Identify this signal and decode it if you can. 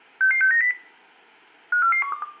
Five-tone selective call (CCIR), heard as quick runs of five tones, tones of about 100 ms, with room echo. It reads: 66690 54412